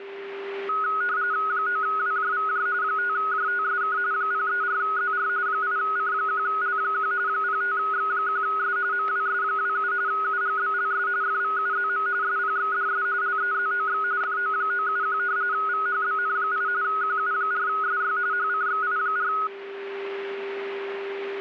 RTTY (45.45 baud, 170 Hz shift), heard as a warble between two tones, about 1360 Hz centre, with static crashes and a steady whistle near 400 Hz. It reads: 9WJVJ 5JTSK 034ZR 8C1L1 05X1S MWS27 UGBLS FVUZM SPXDS LEZOX FO971 VHBN8 QU4SY HCXI4